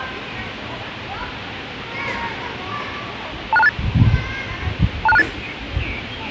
Five-tone selective call (EIA), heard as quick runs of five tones, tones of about 30 ms, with the noise of a park. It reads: 26268 26268